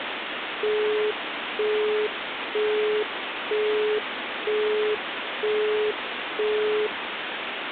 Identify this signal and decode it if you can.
Telephone call progress tone (single-tone plan, as in Europe, Japan and elsewhere), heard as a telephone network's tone, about 420 Hz, 0.48 s on and 0.48 s off, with phone line noise. Busy tone.